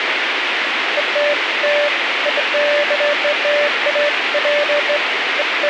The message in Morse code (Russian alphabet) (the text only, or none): none